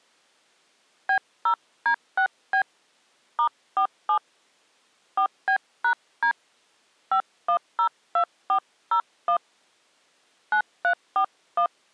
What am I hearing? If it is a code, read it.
DTMF, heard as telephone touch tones, dialled by hand, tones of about 90 ms. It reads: B0D6B *47 4B#D 5102401 9341